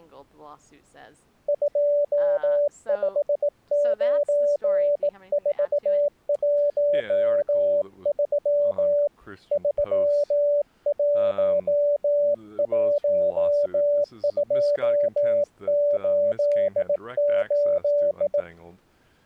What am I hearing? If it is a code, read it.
Morse code, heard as a keyed tone, hand-sent with a bug key, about 18 wpm, 580 Hz, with speech in English. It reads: 259413 311288